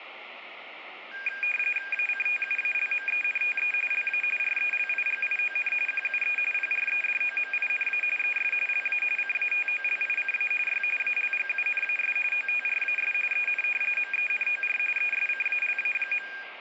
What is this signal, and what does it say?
RTTY (45.45 baud, 850 Hz shift), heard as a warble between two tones, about 2000 Hz centre, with radio static. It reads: ACTUALMENTE LA RELIGION QUE PREDOMINA ES LA CATOLICA Y ALGUNAS OTRAS EN MENOR ESCALA.